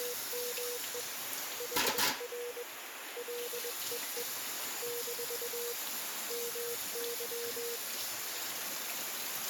Morse code, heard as a keyed tone, hand-sent with a paddle, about 21 wpm, 480 Hz, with radio static and kitchen noise. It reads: … HR LEE - MY